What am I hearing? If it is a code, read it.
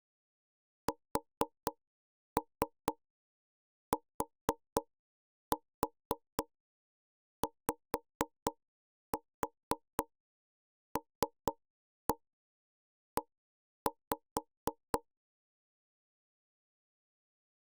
Tap code, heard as knocks on wood, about 4 knocks a second. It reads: STYLE